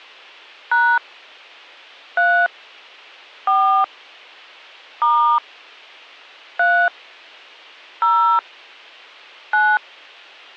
DTMF, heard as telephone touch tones, dialled by hand, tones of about 270 ms. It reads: # 3 4 * 3 0 9